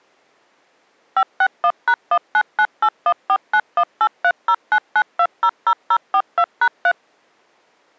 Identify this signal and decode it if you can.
DTMF, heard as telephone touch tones, dialled by machine, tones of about 60 ms. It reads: 561#1998149183099200042#3